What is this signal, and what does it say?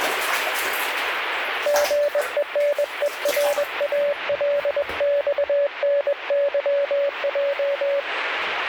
Morse code (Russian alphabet), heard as a keyed tone, hand-sent with a bug key, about 21 wpm, 570 Hz, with radio static and the noise of a restroom. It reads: ГЕНЕРАЛЬНЫЙ